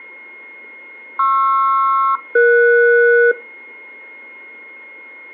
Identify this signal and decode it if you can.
Aircraft SELCAL, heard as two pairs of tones, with a steady whistle near 2150 Hz. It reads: PR-ES